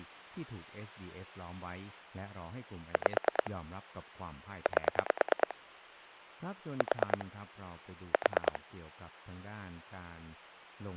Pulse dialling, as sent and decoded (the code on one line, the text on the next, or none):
5 / 8 / 4 / 4
5 8 4 4